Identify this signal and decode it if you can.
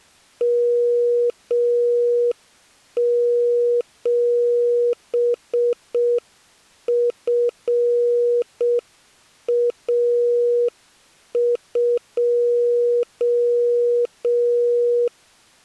Morse code, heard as a keyed tone, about 6 wpm, 480 Hz. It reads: M7FA2